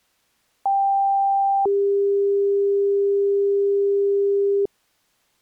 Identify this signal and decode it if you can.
Two-tone page, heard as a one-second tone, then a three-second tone, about 790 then 400 Hz.